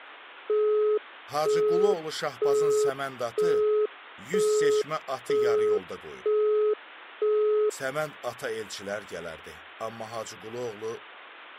Telephone call progress tone (single-tone plan, as in Europe, Japan and elsewhere), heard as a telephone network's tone, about 420 Hz, 0.48 s on and 0.48 s off. Busy tone.